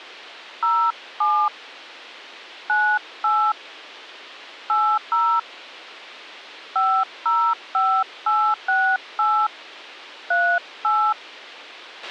DTMF, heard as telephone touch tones, dialled by hand, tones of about 280 ms, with a squelch burst at the end. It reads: 07 98 80 505868 38